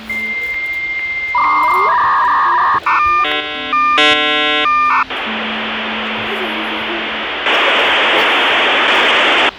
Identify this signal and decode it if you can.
Dial-up modem handshake (V.34 or later), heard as a whistle, warbles, then hiss, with phone line noise and the noise of a crowd indoors.